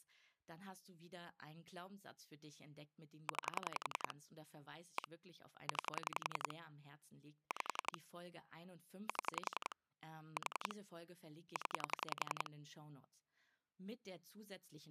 Pulse dialling, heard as clicks on a phone line, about 11 pulses a second, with speech in German. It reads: 9 1 9 5 7 4 0